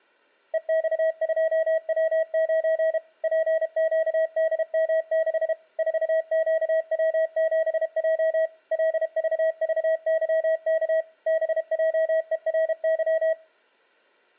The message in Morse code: EX2W9 PQDM6 4QW7J LVVYK BJERY

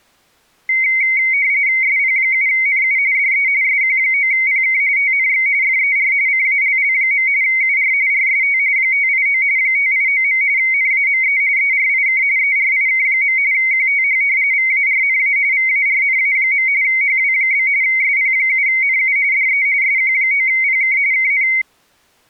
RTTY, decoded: SP7NU DE SQ9PK TNX FER CALL. UR RST 589 589. NAME ERIK ERIK. QTH VARNA VARNA. HW? SP7NU DE SQ9PK KN

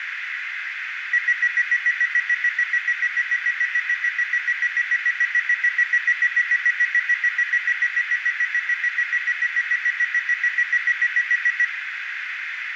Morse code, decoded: none

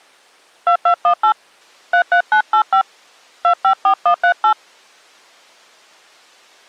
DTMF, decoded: 2218 33985 254138

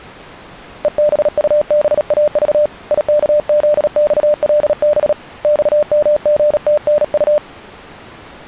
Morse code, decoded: EBUBAV IKZXLB XMGTNU

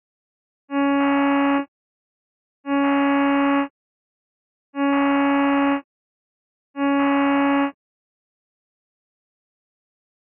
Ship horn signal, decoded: 4 short

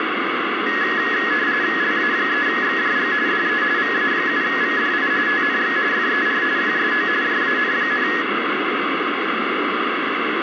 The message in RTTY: LA3XJG DE VA7VDI TNX FER QSO JAN,

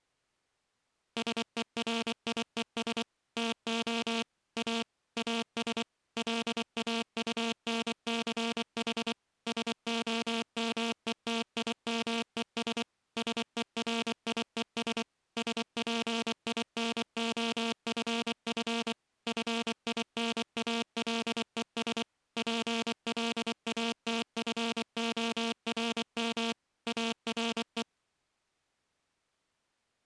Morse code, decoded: SERIES TO A AS LAUNCH SOMETIMES SERIES SPINOFF FINALES PLATFORM ARE

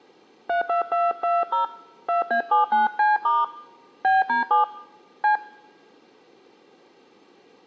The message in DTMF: 32220 2A79C* BD7 C

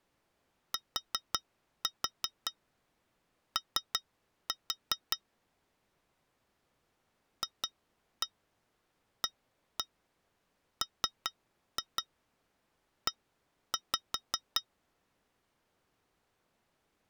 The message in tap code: TO FAME

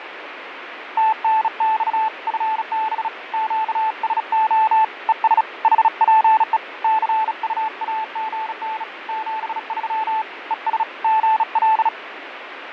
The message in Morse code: TNX FB QSO ES HPE CUAGN 73 ES GL

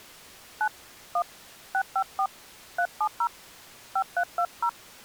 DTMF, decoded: 9 1 654 370 5320

